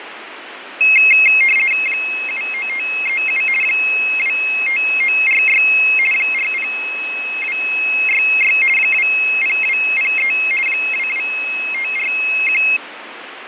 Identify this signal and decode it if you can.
RTTY (50 baud, 450 Hz shift), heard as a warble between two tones, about 2350 Hz centre, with radio static and fading. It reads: 79537 25946 40266 20203 22541